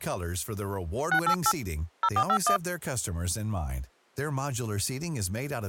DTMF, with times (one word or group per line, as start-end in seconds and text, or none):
1.1-1.5 688
2.0-2.6 0451